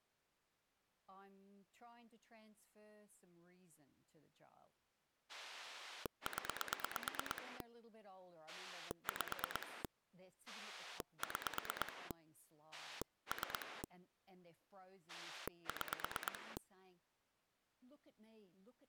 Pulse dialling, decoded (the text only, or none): 0 5 6 3 6